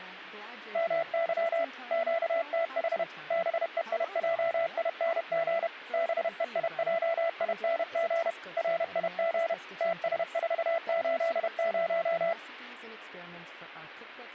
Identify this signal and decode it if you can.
Morse code, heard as a keyed tone, machine-sent, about 31 wpm, 670 Hz, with speech in English. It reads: MY QTH BEIJING BEIJING RIG TS480